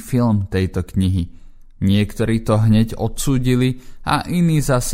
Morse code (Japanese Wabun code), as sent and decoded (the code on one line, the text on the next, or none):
none